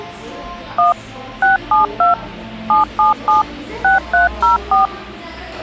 DTMF, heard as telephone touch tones, dialled by machine, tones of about 140 ms, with hum and the noise of a cafe. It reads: 1 672 777 6304